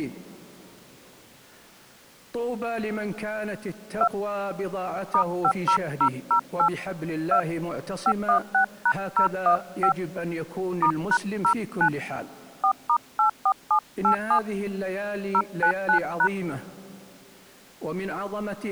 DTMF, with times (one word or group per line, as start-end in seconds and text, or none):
4.0-4.1 2
5.1-6.7 *50008
7.3-7.4 2
8.1-9.9 516#015
10.8-11.9 *#09
12.6-14.4 4*84787
15.3-16.3 099#